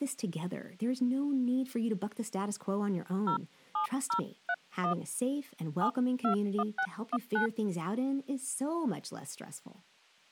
DTMF, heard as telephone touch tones, dialled by hand, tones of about 80 ms, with speech in English. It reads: 07031 721619